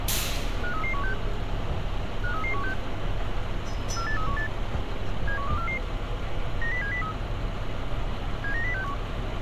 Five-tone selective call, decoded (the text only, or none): 53316 53316 48318 71244 90703 79061